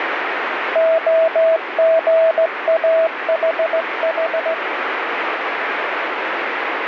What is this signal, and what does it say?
Morse code, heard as a keyed tone, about 16 wpm, 650 Hz, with heavy radio static. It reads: OGAHH